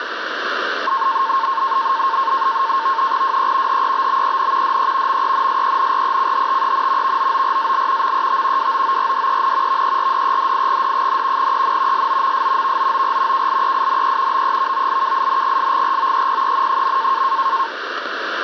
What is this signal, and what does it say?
NAVTEX (SITOR-B), 100 baud, 170 Hz shift, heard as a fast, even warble, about 990 Hz centre, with radio static. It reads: WE HEBBEN DE MENSENRECHTEN VOORAL MET WOORDEN VERDEDIGD, EN SOMS VOOR KLEINE BEVOLKINGSGROEPEN.